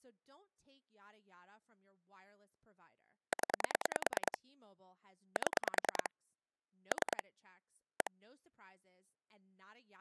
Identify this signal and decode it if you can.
Pulse dialling, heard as clicks on a phone line, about 10 pulses a second, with speech in English. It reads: 0 7 3 1